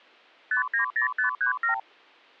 Multi-frequency trunk signalling (R2, with the far end's replies), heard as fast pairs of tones, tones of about 110 ms. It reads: 590537